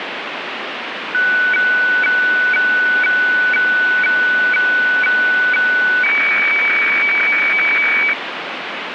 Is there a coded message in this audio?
Yes: weather fax (radiofax), 120 lines a minute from 1.1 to 8.1 s, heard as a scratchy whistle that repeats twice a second, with radio static.